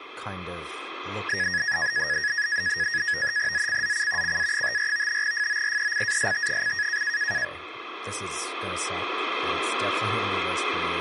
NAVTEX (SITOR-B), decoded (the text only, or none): ZCZC CA54 FORECAST: